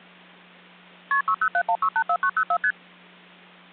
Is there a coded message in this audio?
Yes: multi-frequency trunk signalling (R1, as on North American trunks) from 1.1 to 2.7 s, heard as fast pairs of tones, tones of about 70 ms, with hum. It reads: KP 6071684904 ST